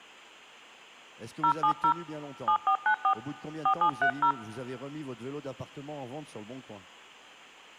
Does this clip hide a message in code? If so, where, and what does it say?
Yes: DTMF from 1.4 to 4.3 s, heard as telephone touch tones, dialled by hand, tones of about 80 ms. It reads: 070 7494 4730